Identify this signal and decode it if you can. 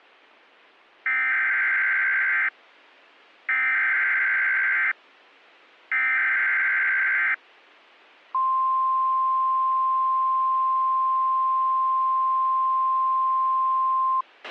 Emergency Alert System (SAME) tones (header bursts, then the 1050 Hz attention tone), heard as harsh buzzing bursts, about 520.83 baud, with a squelch burst at the end.